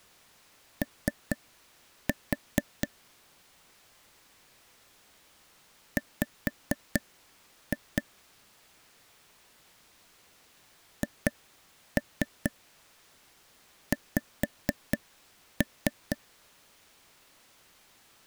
Tap code, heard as taps on a table, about 4 knocks a second. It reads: O W HX